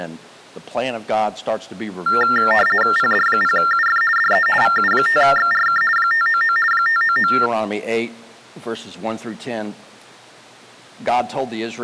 RTTY (50 baud, 450 Hz shift), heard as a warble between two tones, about 1600 Hz centre. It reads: PD0UF DE VU5XRK 599 599